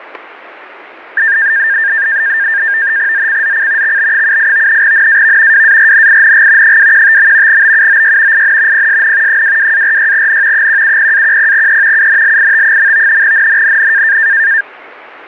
NAVTEX (SITOR-B), 100 baud, 170 Hz shift, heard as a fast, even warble, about 1700 Hz centre. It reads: ZCZC XB78 NAV WARNING 215. BUOY IN PSN 22-46N 170-10E UNLIT. NNNN